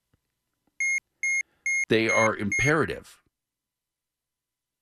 Beep code, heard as a piezo beeper, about 2150 Hz, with speech in English. 5 short. In AMI BIOS tables: processor failure; in Dell tables: CMOS battery failure.